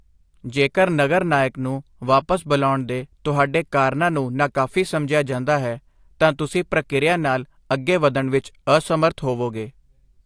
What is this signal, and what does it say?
Speech in Punjabi. There is no code.